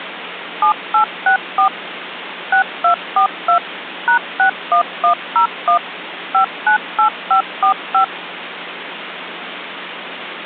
DTMF, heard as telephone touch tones, dialled by machine, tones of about 100 ms, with phone line noise. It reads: 7864 6242 #61101 598545